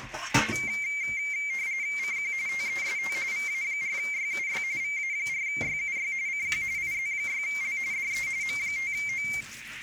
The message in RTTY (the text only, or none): CQ TEST VA4YUY VA4YUY CQ IZ6L DE M5O